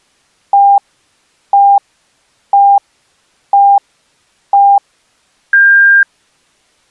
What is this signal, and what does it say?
Radio time signal (five pips and a higher one, as on Chinese radio), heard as pips.